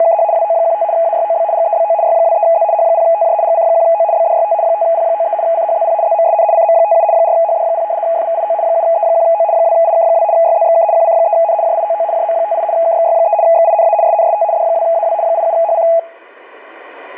RTTY (75 baud, 170 Hz shift), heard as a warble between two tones, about 750 Hz centre, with static crashes. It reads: … WO15 AYOB GEBO Y23Z H0TJ GC1O BDYT 5P93 CHZP ZMSN CM57 4HD0 FVIO 7E1O 2IK2 YZXK QC3N JIOO JM58 KXY3 XINA SNST D2AW 87HC